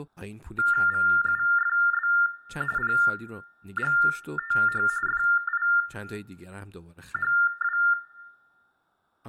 TTY/TDD text telephone tones (45.45 baud Baudot), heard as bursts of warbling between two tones, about 400 Hz shift, 1600 Hz centre, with room echo and speech in Persian. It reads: VUFB PGTH FIHW